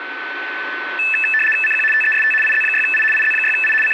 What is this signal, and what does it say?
RTTY (75 baud, 850 Hz shift), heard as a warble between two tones, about 2200 Hz centre, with radio static and a steady whistle near 1510 Hz. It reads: CQ TEST IZ6I IZ6I …